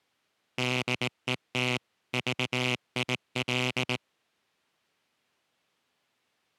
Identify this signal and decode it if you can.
Morse code, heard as a buzzer, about 18 wpm. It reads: DET VIL